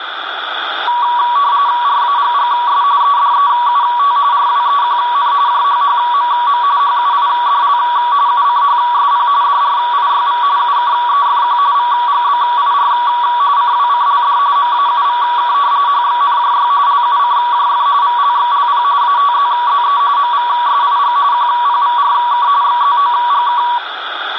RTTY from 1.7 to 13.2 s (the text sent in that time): RAGGS EDEUT RWEQN JHHMM HUIDL UCHSP DRIYV UKEFQ VGBIR